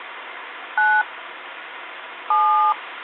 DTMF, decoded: 9 7

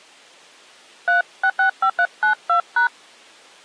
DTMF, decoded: 3665392#

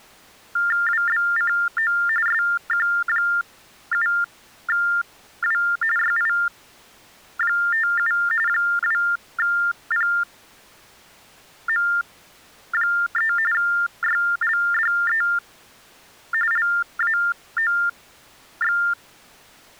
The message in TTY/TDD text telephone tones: WBCO SQ7W YI57 2PM3 YLDE LAOX

